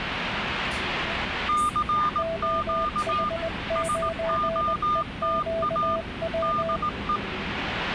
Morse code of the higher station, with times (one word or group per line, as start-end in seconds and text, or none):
1.5-3.3 CQ
3.8-6.0 SOTA
6.4-7.2 DE